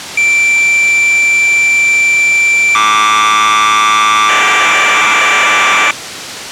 Cassette data (Kansas City type), 1200 baud, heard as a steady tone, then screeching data.